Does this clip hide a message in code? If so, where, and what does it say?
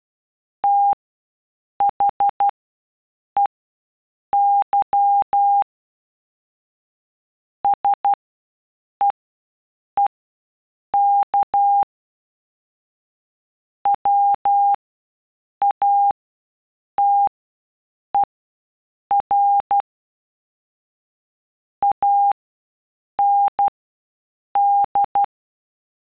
Yes: Morse code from 0.6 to 25.3 s, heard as a keyed tone, machine-sent, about 12 wpm, spaced as for 7 wpm, 810 Hz. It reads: THEY SEEK WATER AND